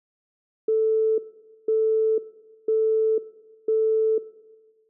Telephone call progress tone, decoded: busy tone

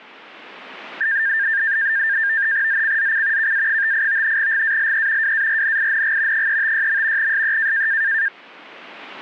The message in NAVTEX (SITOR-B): ZCZC KA58 GALE WARNING 356. SE

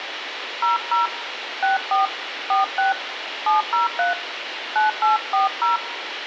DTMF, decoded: 00 64 46 703 9840

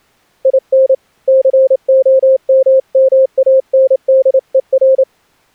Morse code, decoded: IN COMMANDER

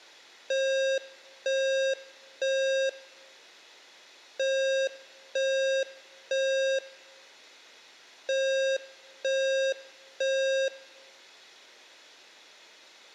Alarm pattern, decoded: temporal three

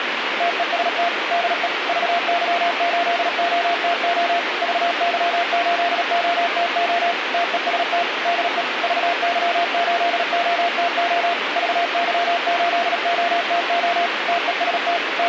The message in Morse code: TEST DE VY8OTO VY8OTO TEST DE VY8OTO VY8OTO TEST …

